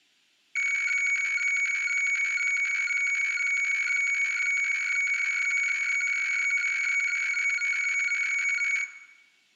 Weather fax (radiofax), 120 lines a minute, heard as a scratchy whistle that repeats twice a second, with room echo.